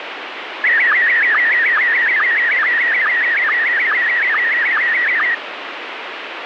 SSTV (slow-scan television), Scottie S1, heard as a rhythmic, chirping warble, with radio static.